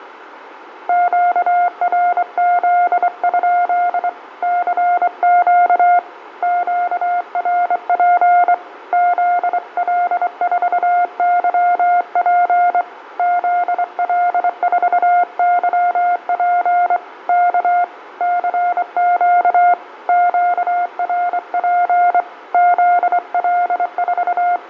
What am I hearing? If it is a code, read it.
Morse code, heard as a keyed tone, hand-sent with a straight key, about 24 wpm, 710 Hz, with room echo. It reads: QRZ? CQ QRP ZL4YP ZL4YP K CQ QRP …